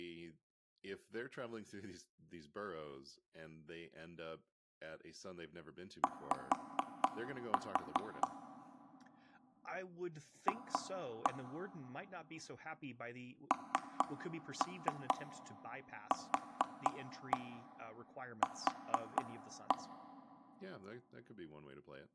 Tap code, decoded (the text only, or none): Y F NQQ